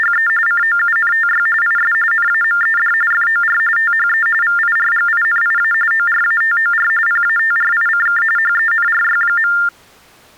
TTY/TDD text telephone tones (45.45 baud Baudot), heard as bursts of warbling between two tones, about 400 Hz shift, 1600 Hz centre. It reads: … COUNTY IS NAMED FOR THE VIRGINIA ORATOR PATRICK HENRY.